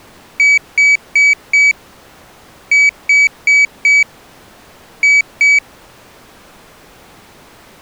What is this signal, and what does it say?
Beep code, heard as a piezo beeper, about 2300 Hz. 4-4-2. In Phoenix BIOS tables: parallel port failure.